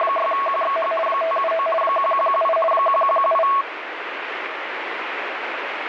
RTTY (50 baud, 450 Hz shift), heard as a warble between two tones, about 880 Hz centre, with radio static. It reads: … 579 1118 1118